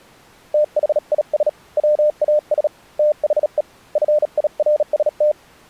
Morse code, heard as a keyed tone, hand-sent with a bug key, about 37 wpm, 600 Hz. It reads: THIS WAS THE FIRST